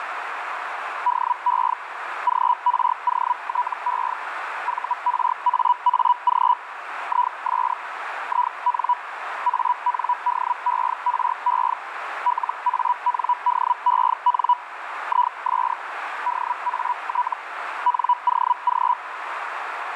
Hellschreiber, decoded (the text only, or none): DE GROTE VRAAG IS IN ANDERE LANDEN IS DAT NOG